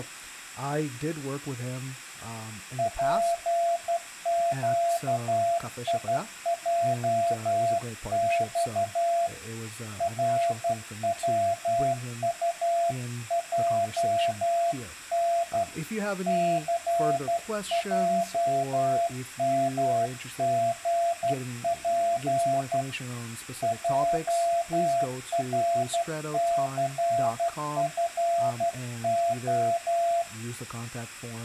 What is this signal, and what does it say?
Morse code, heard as a keyed tone, hand-sent with a straight key, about 12 wpm, 680 Hz, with speech in English. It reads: PQIJX RWUJN CJMGP JRCFO